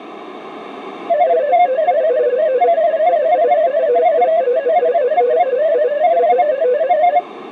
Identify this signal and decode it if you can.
Multi-tone FSK (Olivia or MFSK type), about 250 Hz wide, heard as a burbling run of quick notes, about 31.25 baud.